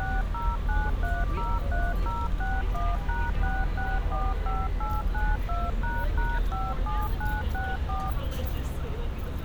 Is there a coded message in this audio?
Yes: DTMF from 0.0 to 8.1 s, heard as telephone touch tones, dialled by machine, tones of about 210 ms, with street noise. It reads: 609303061#6645892##57964